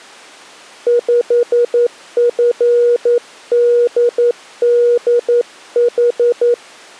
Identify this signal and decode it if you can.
Morse code, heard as a keyed tone, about 11 wpm, 480 Hz. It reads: 5FDDH